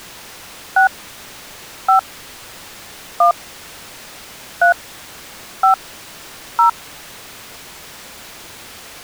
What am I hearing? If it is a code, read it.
DTMF, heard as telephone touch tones, dialled by hand, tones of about 110 ms. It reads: 6 5 1 3 5 0